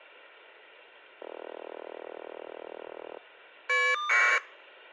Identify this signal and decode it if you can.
Caller ID data burst, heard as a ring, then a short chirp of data, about 1200 baud.